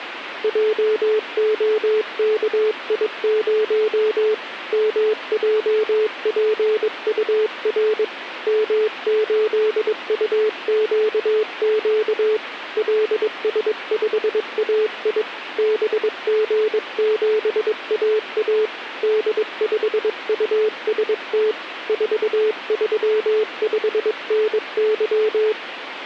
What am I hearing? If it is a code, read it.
Morse code, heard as a keyed tone, hand-sent with a paddle, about 22 wpm, 430 Hz, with radio static. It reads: JOKI0 MJPUR M8UQQ LS5AI BG7AA D5UST 435NY